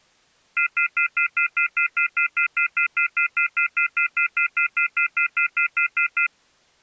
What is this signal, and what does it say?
Telephone call progress tone (North American plan), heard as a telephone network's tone, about 1400, 2050, 2450, 2600 Hz, 0.1 s on and 0.1 s off. Off-hook warning tone.